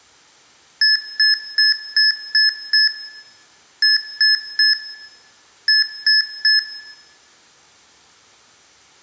Beep code, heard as beeps from a small speaker, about 1700 Hz, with room echo. 6-3-3.